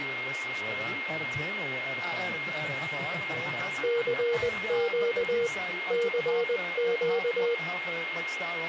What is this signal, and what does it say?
Morse code, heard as a keyed tone, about 20 wpm, 470 Hz, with radio static and a steady whistle near 2130 Hz. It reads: CQ CQ